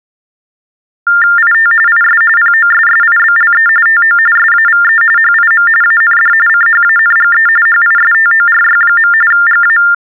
TTY/TDD text telephone tones (45.45 baud Baudot), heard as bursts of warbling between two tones, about 400 Hz shift, 1600 Hz centre. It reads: IT IS POSSIBLE TO SAVE HIM AND CHANGE HISTORY. GA